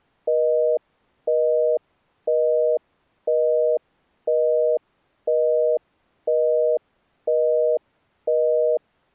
Telephone call progress tone (North American plan), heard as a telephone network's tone, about 480, 620 Hz, 0.5 s on and 0.5 s off. Busy tone.